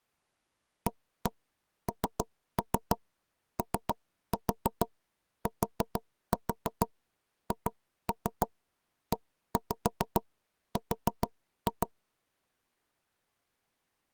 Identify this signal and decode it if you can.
Tap code, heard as knocks on wood, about 6 knocks a second. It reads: ANOTHER